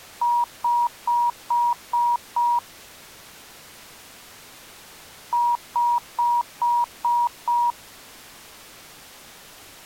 Beep code, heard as beeps, played twice, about 960 Hz. 6 short. In AMI BIOS tables: keyboard controller gate A20 failure; in Dell tables: video card failure.